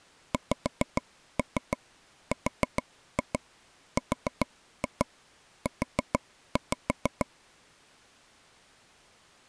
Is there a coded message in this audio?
Yes: tap code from 0.3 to 7.3 s, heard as taps on a table, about 6 knocks a second. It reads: XRRU